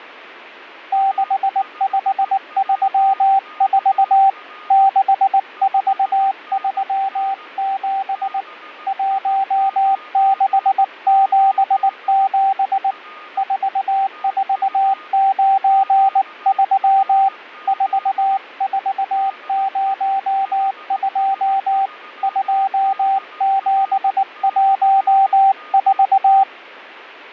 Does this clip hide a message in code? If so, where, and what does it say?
Yes: Morse code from 0.9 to 26.5 s, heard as a keyed tone, hand-sent with a paddle, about 19 wpm, 780 Hz, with fading and a weaker station near 1230 Hz. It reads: 6534 6437 1677 4493 4402 2714